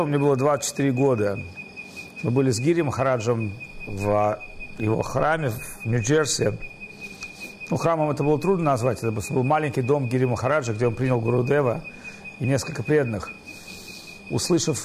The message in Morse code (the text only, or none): none